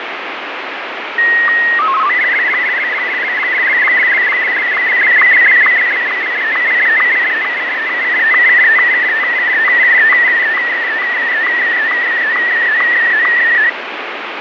SSTV (slow-scan television), Martin M1, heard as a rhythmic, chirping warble, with heavy radio static and fading.